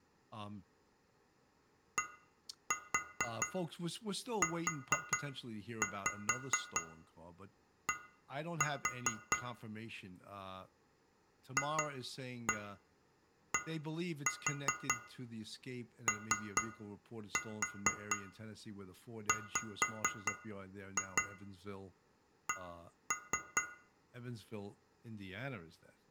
Tap code, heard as taps on glass, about 4 knocks a second, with room echo and speech in English. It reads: DUD FDOWC